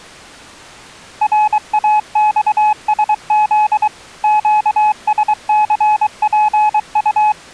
Morse code, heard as a keyed tone, machine-sent, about 23 wpm, 850 Hz. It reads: RAXSZ QSCPU